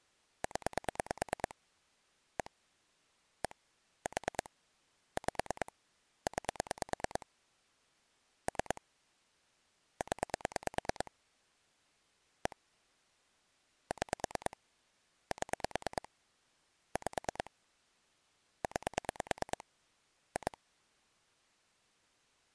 Pulse dialling, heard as clicks on a phone line, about 9 pulses a second. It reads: 0 1 1 4 5 9 3 0 1 6 7 5 9 2